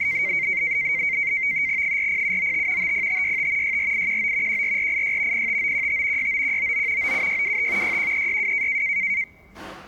NAVTEX (SITOR-B), 100 baud, 170 Hz shift, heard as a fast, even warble, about 2150 Hz centre, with the noise of a crowd indoors. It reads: 40795 50565 64819 14486 05915 69199 97625 61362